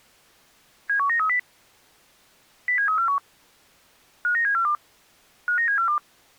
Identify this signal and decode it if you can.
Five-tone selective call (CCIR), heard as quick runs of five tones, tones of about 100 ms. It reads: 71930 07341 59742 59742